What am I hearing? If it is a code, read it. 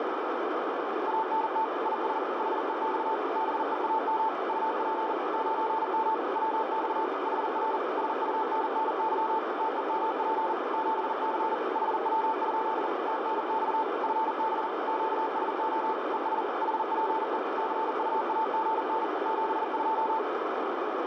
Morse code, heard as a keyed tone, machine-sent, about 40 wpm, 880 Hz, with heavy radio static. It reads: ANT IS HEX BEAM UP 9M WX HR SUNNY TEMP 7C HW? TNX FB QSO ES HPE CUAGN 72